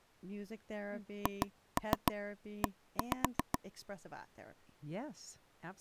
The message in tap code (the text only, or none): HE